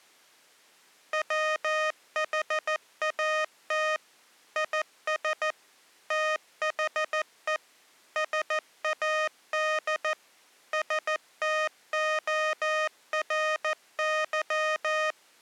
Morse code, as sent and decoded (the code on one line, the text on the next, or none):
.-- .... .- - / .. ... / - .... . / ... .- -.. / ... - --- .-. -.--
WHAT IS THE SAD STORY